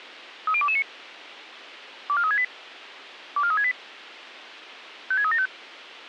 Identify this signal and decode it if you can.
Five-tone selective call (ZVEI), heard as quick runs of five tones, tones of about 70 ms, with radio hiss. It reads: 30229 24368 24368 56375